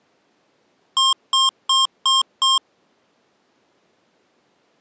Beep code, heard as beeps from a small speaker, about 1070 Hz. 5 short. In AMI BIOS tables: processor failure; in Dell tables: CMOS battery failure.